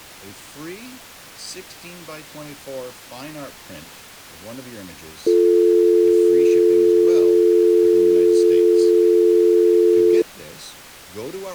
Telephone call progress tone (North American or UK plan), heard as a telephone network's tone, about 350, 440 Hz, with speech in English. Dial tone.